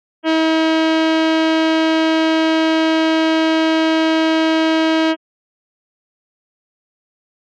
Ship horn signal, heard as a ship's horn, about 320 Hz. 1 long. At sea: a vessel nearing a blind bend, or under power and making way in fog.